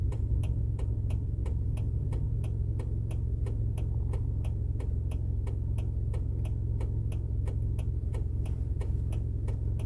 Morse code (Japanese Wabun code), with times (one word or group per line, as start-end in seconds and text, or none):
none